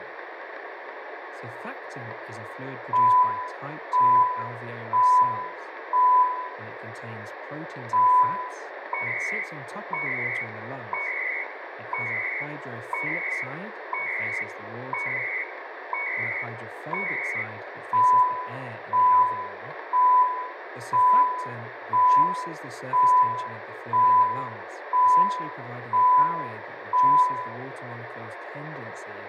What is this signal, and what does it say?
Radio time signal (CHU, Canada), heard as beeps and data bursts, one a second, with radio static, room echo and speech in English.